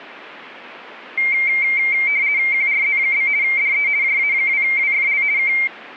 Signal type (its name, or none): RTTY